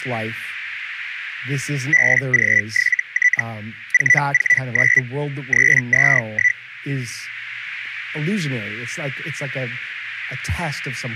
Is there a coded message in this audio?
Yes: Hellschreiber (Feld-Hell, 122.5 baud) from 1.9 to 6.6 s, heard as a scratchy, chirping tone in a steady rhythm, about 2000 Hz, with speech in English. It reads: BG7T 449 321